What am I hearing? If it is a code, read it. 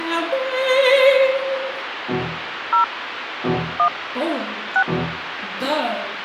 DTMF, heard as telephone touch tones, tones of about 100 ms, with phone line noise. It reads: 0 1 6